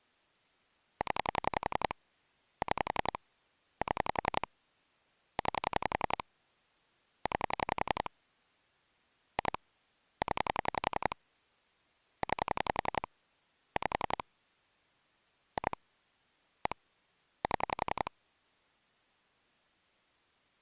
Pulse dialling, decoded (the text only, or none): 0 6 7 9 9 2 0 9 5 2 1 7